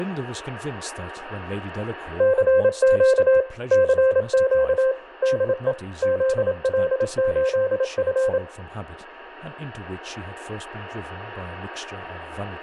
Morse code, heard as a keyed tone, machine-sent, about 27 wpm, 520 Hz, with a steady whistle near 940 Hz, room echo and speech in English. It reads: CQ CQ DE ZL8F